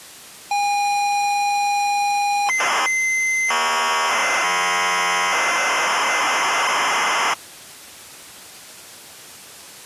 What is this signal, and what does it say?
ZX Spectrum tape loading, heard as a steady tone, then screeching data.